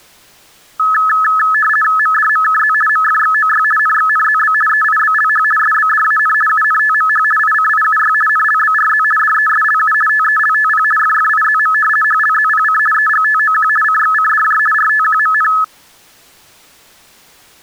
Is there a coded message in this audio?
Yes: RTTY (50 baud, 450 Hz shift) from 0.8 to 15.6 s, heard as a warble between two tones, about 1500 Hz centre. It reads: MDMKZ MFXOY NXNZB EIBLH SBDAN UNTMH ICIUY NLBRZ DESLU TELTP FFIZM HLZPC EGTOQ CXCDJ RTQMN